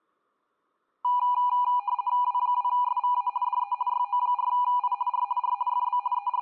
RTTY (50 baud, 170 Hz shift), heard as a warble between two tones, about 900 Hz centre. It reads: W2SVA DE YO4I R R FB …